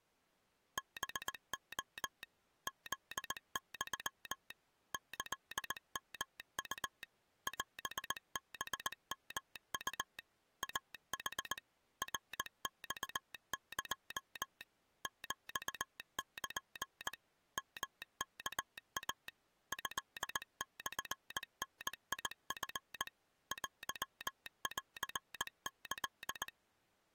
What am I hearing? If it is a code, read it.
Morse code (Japanese Wabun code), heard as a telegraph sounder, machine-sent, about 19 wpm. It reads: ハレ フユ キヨウ オハヨウ イヌ ナマエ ヒル ヨワイ トモダチ テンキ